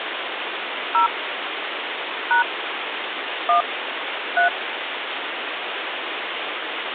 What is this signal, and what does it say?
DTMF, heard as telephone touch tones, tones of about 120 ms, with phone line noise. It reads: 0 # 1 3